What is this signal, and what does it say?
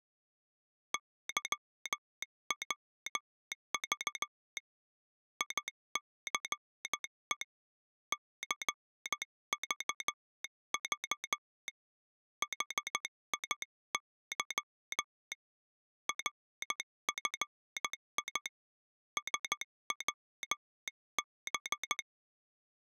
Morse code, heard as a telegraph sounder, hand-sent with a straight key, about 14 wpm. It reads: YWV ICE CVV HIY RFI SWB